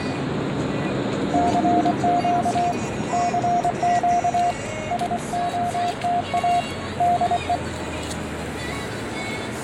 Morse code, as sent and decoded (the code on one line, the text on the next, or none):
-.-. --.- / -.-. --.- / ... --- - .- / -.. .
CQ CQ SOTA DE